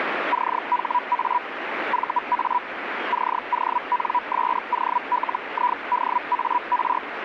Hellschreiber (Feld-Hell, 122.5 baud), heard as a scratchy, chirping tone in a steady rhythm, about 980 Hz, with radio static. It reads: CHA VA CONSOLIDAR